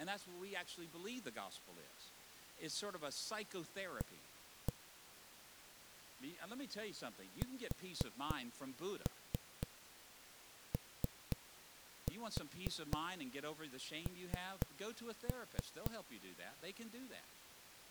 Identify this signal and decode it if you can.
Tap code, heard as knocks on a wall, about 4 knocks a second, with speech in English. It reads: A SON